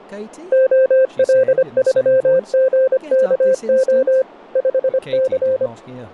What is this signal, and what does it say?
Morse code, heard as a keyed tone, machine-sent, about 25 wpm, 520 Hz, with speech in English. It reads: OL3GKO 5C